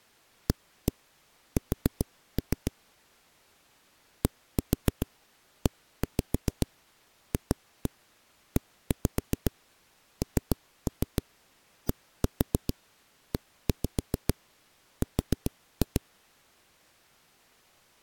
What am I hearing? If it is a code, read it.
Tap code, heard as knocks on a wall, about 7 knocks a second. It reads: AS DEFENDER